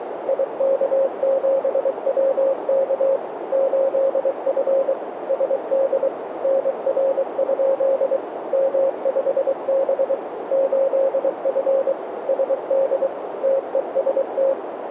Morse code, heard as a keyed tone, machine-sent, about 23 wpm, 540 Hz, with radio static and a narrow filter. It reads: IK7WK 8F SD NR? M5B 8F SD TEST